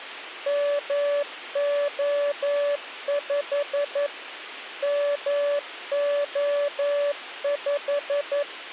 Morse code, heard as a keyed tone, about 11 wpm, 580 Hz, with radio hiss. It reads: MO5 MO5